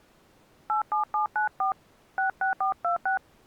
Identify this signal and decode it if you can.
DTMF, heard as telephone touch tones, dialled by hand, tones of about 120 ms. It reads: 87794 66426